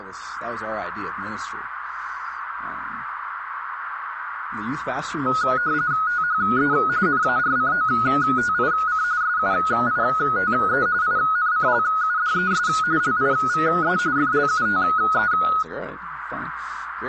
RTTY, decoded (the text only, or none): THE NARCOTIC SUITE INCLUDES LIVE FLUTE